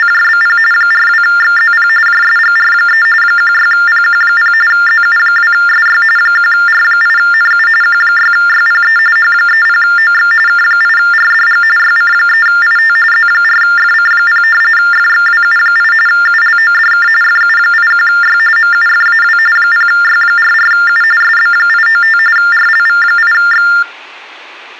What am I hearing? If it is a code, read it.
TTY/TDD text telephone tones (45.45 baud Baudot), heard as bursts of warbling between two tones, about 400 Hz shift, 1600 Hz centre. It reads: … 42XZP JSGR3 16PQ0 ZU2SY 1R8NU Q6YPE H30OX K8RDG YC3IT Z4FC0 FXWU8 ULODK FU81Y MUFAW 0Y44U SB895 RLV8X